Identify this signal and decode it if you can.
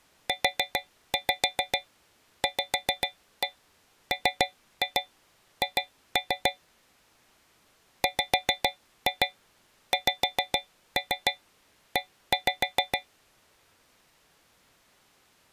Tap code, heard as taps on a metal pipe, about 7 knocks a second. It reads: UVMH WXE